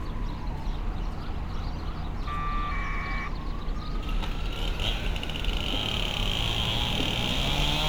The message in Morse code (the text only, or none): none